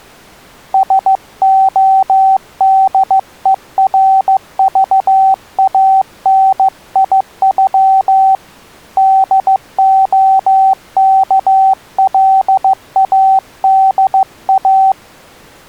Morse code (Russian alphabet), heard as a keyed tone, hand-sent with a paddle, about 15 wpm, 770 Hz. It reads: СОДЕРЖАНИЮ ДОКЛАДА